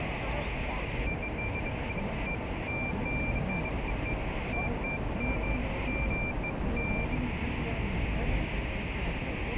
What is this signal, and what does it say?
Beeps of irregular length, with radio static, a narrow filter and the noise inside a car. There is no code.